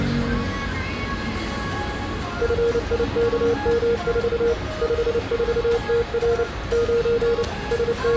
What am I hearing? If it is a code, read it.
Morse code, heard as a keyed tone, machine-sent, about 29 wpm, 470 Hz, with street noise. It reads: FIKM4 54TR 9 …